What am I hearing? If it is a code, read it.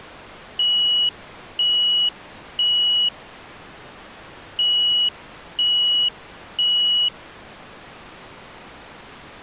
Alarm pattern, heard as an alarm's beeps, played twice, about 2900 Hz. Temporal three. Smoke or fire, evacuate.